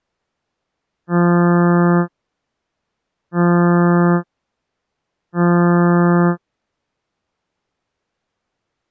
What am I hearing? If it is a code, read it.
Ship horn signal, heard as a ship's horn, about 170 Hz. 3 short. At sea: I am operating astern propulsion.